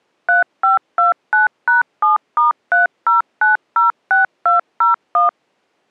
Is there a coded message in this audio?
Yes: DTMF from 0.3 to 5.3 s, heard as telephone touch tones, dialled by machine, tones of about 140 ms. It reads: 3529#7*30906201